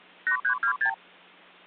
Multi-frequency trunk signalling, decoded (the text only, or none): 8326